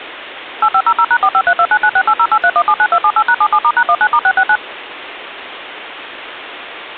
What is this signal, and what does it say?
DTMF, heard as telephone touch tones, dialled by machine, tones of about 60 ms, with phone line noise. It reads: 8500#45329968083179278#77*#19*669